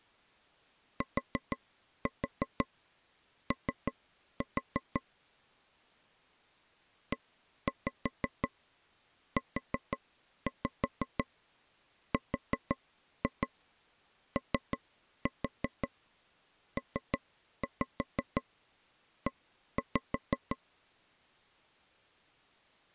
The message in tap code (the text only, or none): TO EUROPE